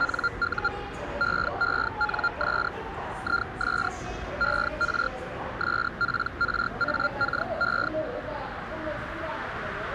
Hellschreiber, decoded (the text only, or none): NU EENS IS ER SPRAKE